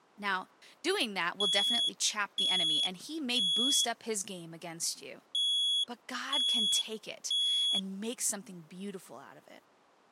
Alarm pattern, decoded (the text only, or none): temporal three